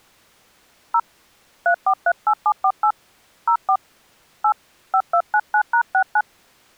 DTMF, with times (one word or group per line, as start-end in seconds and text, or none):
0.9-1.0 0
1.7-2.9 3438748
3.5-3.8 04
4.4-4.5 8
4.9-6.2 5299#69